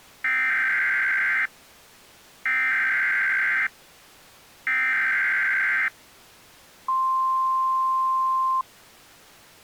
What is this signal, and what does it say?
Emergency Alert System (SAME) tones (header bursts, then the 1050 Hz attention tone), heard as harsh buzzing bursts, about 520.83 baud.